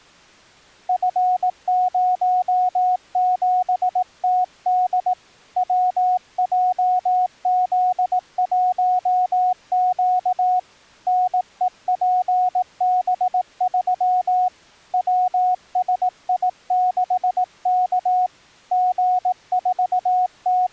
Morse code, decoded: F07TD WJZ1Q NEPB3 WSI6K …

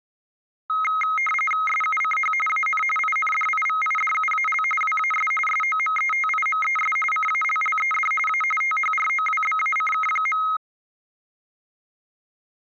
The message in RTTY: SUCH AN INDIVIDUAL WAS SOMETIMES CALLED A THROWBACK.

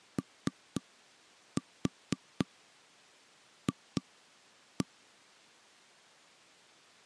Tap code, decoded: OF

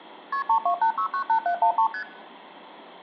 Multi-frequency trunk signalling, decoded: KP 328698713 ST

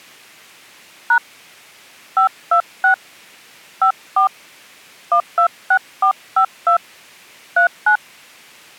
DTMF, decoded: # 526 54 126452 39

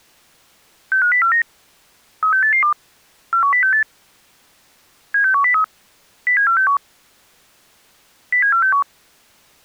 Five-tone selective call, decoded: 65049 36882 41068 76103 07461 07461

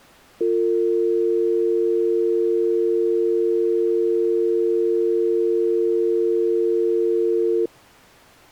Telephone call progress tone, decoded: dial tone

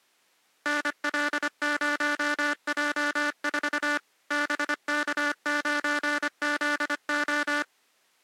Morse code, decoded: NL0J4 BK9ZO

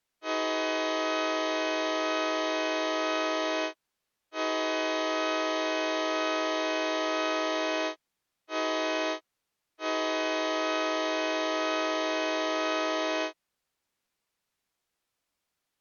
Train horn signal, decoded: 2 long, 1 short, 1 long

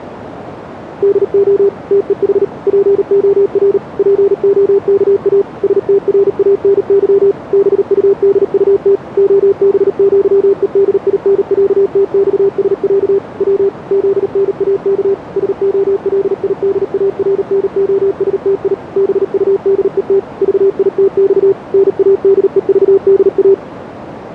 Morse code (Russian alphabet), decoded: ДО ТЕХ ПОР ПОКА СТРАНЫ БУДУТ ОБЪЕДИНЯТЬСЯ В ЗНАК СОЛИДАРНОСТИ БУДЕТ ЖИТЬ НАДЕЖДА

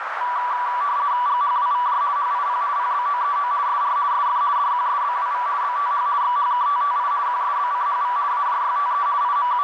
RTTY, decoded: GHWVJ HIP PBOEO SR SF DQSBWV BTH XHKTTI QSBCHV AJYTE …

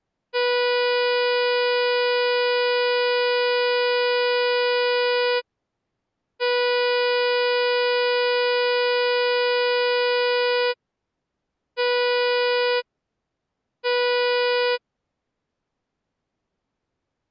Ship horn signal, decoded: 2 long, 2 short

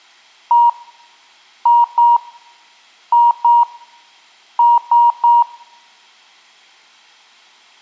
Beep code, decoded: 1-2-2-3

